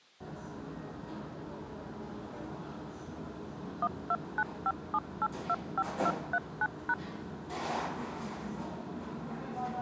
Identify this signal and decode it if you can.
DTMF, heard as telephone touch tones, dialled by machine, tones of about 50 ms, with the noise of a restaurant. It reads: 12957825239#